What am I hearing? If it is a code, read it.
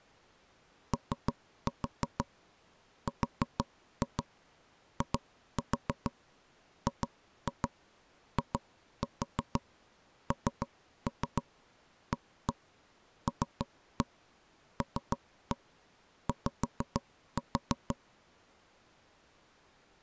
Tap code, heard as knocks on wood, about 6 knocks a second. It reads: ORIGINALLY